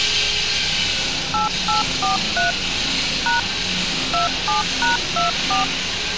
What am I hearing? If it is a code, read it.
DTMF, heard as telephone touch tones, dialled by machine, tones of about 140 ms, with street noise. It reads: 8843 # 27#24